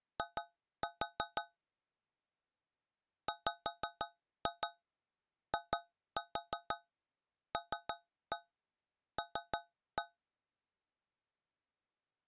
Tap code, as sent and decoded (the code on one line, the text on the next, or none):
2-4 / 5-2 2-4 3-1 3-1
I WILL